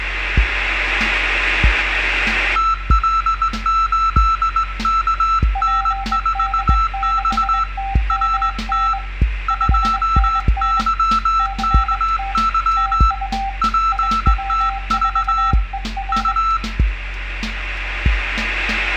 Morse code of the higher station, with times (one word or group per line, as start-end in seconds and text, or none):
2.6-7.6 TL8KN4X
8.1-8.9 RT
9.5-13.1 2YKY
13.6-15.5 PTV
16.1-16.6 U